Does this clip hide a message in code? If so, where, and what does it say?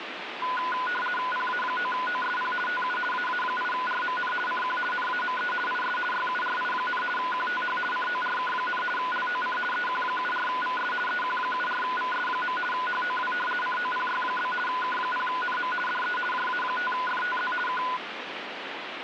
Yes: RTTY (50 baud, 450 Hz shift) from 0.4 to 18.0 s, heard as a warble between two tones, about 1240 Hz centre, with radio static. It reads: PA9OSP TU AA8RMN CQ NAME IS YURI, QTH CORK, LOC EQ74VS EQ74VS. HOW COPY? K0NM DE JA5FTZ K